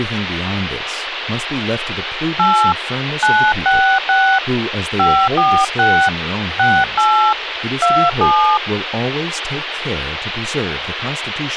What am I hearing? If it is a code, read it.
DTMF, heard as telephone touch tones, dialled by hand, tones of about 300 ms, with phone line noise and speech in English. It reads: 8 966 546 68 27